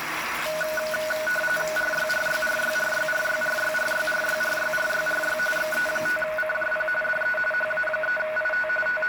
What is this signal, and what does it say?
RTTY (45.45 baud, 850 Hz shift), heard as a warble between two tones, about 1050 Hz centre, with radio static, room echo and the noise of a restroom. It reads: RYRYRYRYRYRYRYRYRYRYRY XE5CJP DE HA3IT …